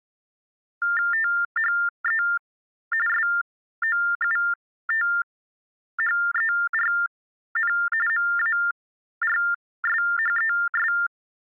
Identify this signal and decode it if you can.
TTY/TDD text telephone tones (45.45 baud Baudot), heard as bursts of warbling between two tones, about 400 Hz shift, 1600 Hz centre. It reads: THE SOUTHERN MARSHES